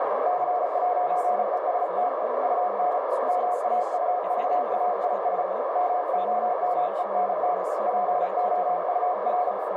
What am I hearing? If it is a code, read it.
Morse code, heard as a keyed tone, hand-sent with a paddle, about 35 wpm, 720 Hz, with heavy radio static, a narrow filter and speech in German. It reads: C'EST UN MAUVAIS MOMENT POUR